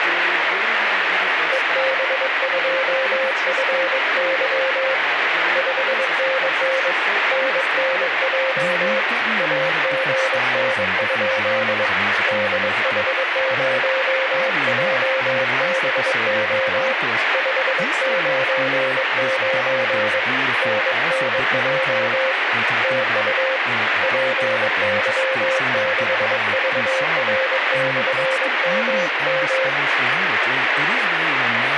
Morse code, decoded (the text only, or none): EB2FY 5NN NNJ AGN? DH0JBO 599 NNJ TU PY6VR/MM